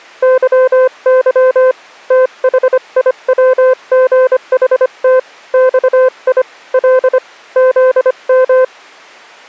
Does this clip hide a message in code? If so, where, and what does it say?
Yes: Morse code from 0.2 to 8.7 s, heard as a keyed tone, hand-sent with a paddle, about 25 wpm, 510 Hz. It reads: YY THIWGHT XI L ZM